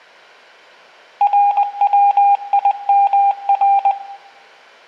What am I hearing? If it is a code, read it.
Morse code, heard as a keyed tone, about 20 wpm, 800 Hz, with room echo. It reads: RWIMR